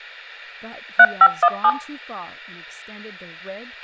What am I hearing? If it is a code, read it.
DTMF, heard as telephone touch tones, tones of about 60 ms, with a squelch burst at the end and speech in English. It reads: 3517